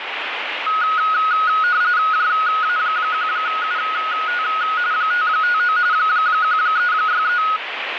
RTTY (45.45 baud, 170 Hz shift), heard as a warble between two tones, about 1360 Hz centre, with radio static. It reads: JA1UT 559 1363